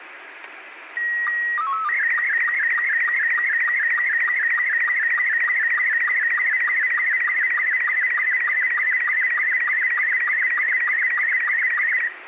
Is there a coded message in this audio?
Yes: SSTV (slow-scan television), Robot 72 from 1.0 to 12.1 s, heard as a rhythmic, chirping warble, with radio static and room echo.